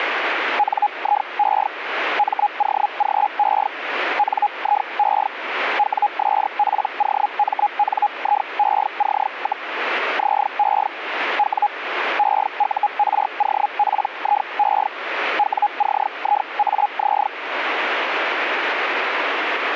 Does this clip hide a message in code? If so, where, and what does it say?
Yes: Hellschreiber (Feld-Hell, 122.5 baud) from 0.6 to 17.3 s, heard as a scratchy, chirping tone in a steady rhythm, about 830 Hz, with radio static. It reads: NIE MOGE NIE WSPOMNIEC, ZE W EUROPIE WCIAZ